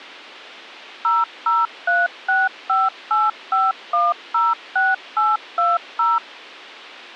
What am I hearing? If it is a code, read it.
DTMF, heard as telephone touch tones, dialled by machine, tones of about 190 ms. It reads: 0036585106820